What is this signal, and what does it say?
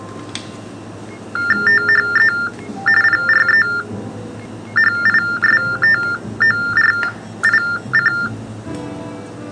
TTY/TDD text telephone tones (45.45 baud Baudot), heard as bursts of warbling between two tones, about 400 Hz shift, 1600 Hz centre, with the noise of a cafe. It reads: THE PREHISTORIC